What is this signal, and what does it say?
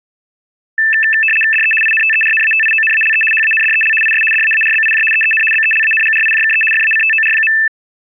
RTTY (75 baud, 850 Hz shift), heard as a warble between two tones, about 2200 Hz centre. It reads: DE INTERNATIONALE HANDEL IS DAARBIJ EEN BELANGRIJKE FACTOR.